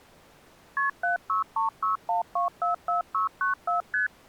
Multi-frequency trunk signalling (R1, as on North American trunks), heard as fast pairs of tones, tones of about 130 ms. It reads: KP 76361244694 ST